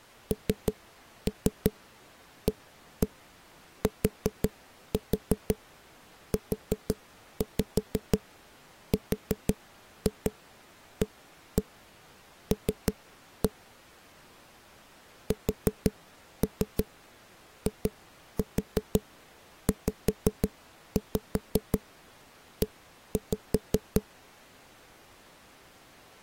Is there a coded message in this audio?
Yes: tap code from 0.3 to 24.0 s, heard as knocks on a wall, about 5 knocks a second. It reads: NATURAL SIZE